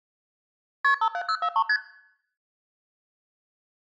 Multi-frequency trunk signalling (R1, as on North American trunks), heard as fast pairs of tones, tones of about 70 ms. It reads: KP 57043 ST